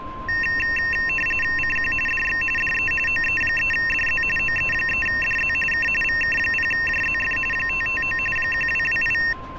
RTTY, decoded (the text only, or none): CQ DX DE OE3DZ OE3DZ K VK0JZF 559 1228